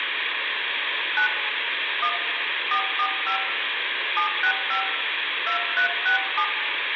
DTMF, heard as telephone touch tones, dialled by hand, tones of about 100 ms, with phone line noise and room echo. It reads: 9 1 445 765 2367